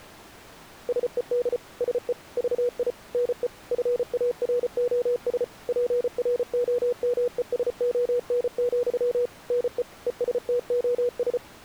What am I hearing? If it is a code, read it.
Morse code, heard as a keyed tone, machine-sent, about 34 wpm, 490 Hz. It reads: SED SE VI NE FAROS PROMESON, NE ESTOS